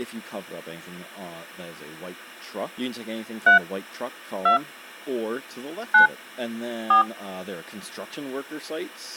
DTMF, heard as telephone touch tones, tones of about 120 ms, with speech in English. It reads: 3 2 9 4